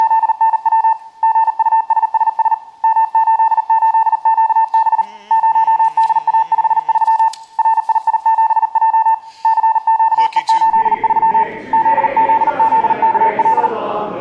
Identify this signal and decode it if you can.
Morse code, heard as a keyed tone, hand-sent with a paddle, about 39 wpm, 890 Hz, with room echo. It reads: … GUSSS M88QB 0DA53 RII7J CQE83 ZZZKL